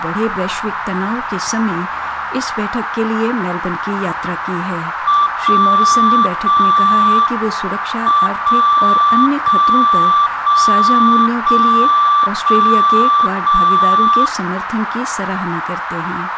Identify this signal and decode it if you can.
Radio time signal (WWVB), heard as a tone whose level steps once a second, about 1170 Hz, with radio static and a narrow filter. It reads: 0 0 M 0 0 0 0 0 0